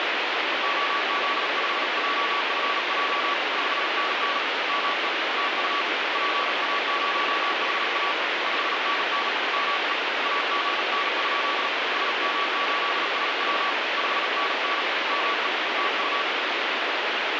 Morse code, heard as a keyed tone, hand-sent with a paddle, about 38 wpm, 1140 Hz, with heavy radio static. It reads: OZ5JFJ 5NN ME TU PA0HA 5NN ME AGN? SM8SW 5NN ME TU